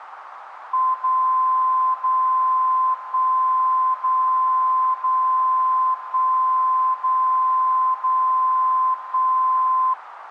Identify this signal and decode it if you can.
Radio time signal (DCF77), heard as a tone whose level steps once a second, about 1030 Hz, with radio static. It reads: 0 0 1 0 0 1 0 0 1